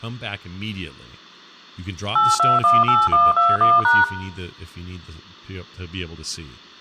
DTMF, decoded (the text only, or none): 8218121#